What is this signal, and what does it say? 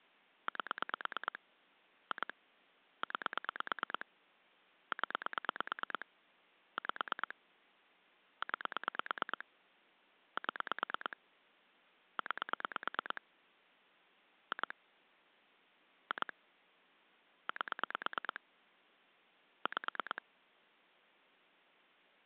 Pulse dialling, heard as clicks on a phone line, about 9 pulses a second. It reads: 8 2 9 0 5 9 7 9 2 2 8 5